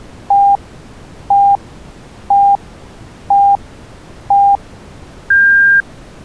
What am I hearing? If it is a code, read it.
Radio time signal (five pips and a higher one, as on Chinese radio), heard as pips.